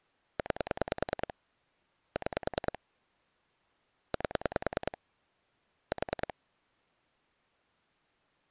Pulse dialling, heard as clicks on a phone line, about 10 pulses a second. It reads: 9 6 8 4